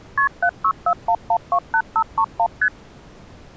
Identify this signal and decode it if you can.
Multi-frequency trunk signalling (R1, as on North American trunks), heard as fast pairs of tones, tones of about 70 ms. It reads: KP 7641128531 ST